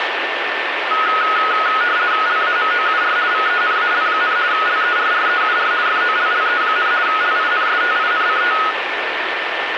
RTTY (50 baud, 170 Hz shift), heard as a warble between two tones, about 1360 Hz centre, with radio static and a steady whistle near 1790 Hz. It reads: LAMOUR VENAL, LERREUR FOLLE, LINSTINCT